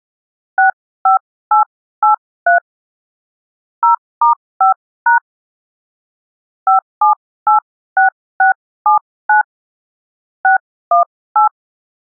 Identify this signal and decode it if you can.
DTMF, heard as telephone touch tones, dialled by hand, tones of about 120 ms. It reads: 65883 0*5# 5786679 618